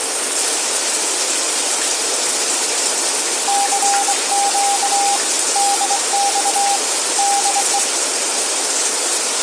Morse code, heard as a keyed tone, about 24 wpm, 800 Hz, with radio static, room echo and the noise of a restroom. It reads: CQ DX DE